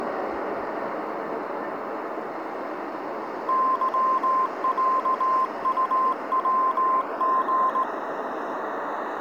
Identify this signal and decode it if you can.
Morse code (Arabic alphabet), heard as a keyed tone, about 17 wpm, 1040 Hz, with street noise. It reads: ظعطوغ